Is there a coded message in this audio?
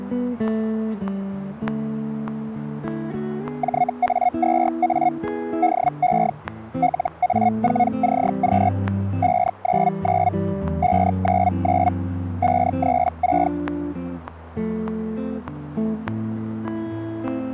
Yes: Hellschreiber (Feld-Hell, 122.5 baud) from 3.6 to 13.5 s, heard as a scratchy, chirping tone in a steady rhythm, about 720 Hz. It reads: JA2A DE LA4CQ 599 599 536